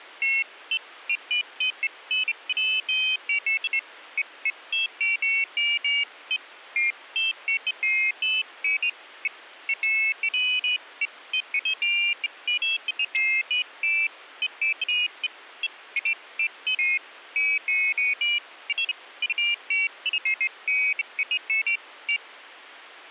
Pairs of high tones at irregular times. There is no code.